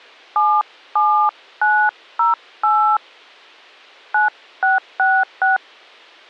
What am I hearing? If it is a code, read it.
DTMF, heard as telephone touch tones, dialled by hand, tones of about 240 ms. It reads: 77908 9666